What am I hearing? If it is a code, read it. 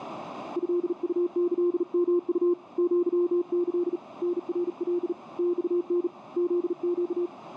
Morse code (Japanese Wabun code), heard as a keyed tone, hand-sent with a bug key, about 38 wpm, 350 Hz, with radio static. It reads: トウキヨウ アキ タナカ マタ フネ